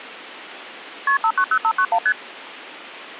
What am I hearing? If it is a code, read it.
Multi-frequency trunk signalling (R1, as on North American trunks), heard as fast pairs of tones, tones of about 70 ms. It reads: KP 590591 ST